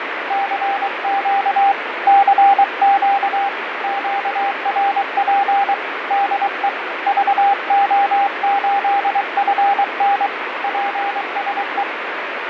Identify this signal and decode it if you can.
Morse code, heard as a keyed tone, hand-sent with a paddle, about 23 wpm, 800 Hz, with radio static and fading. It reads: CQ CQ QRP DE VO8FN PSE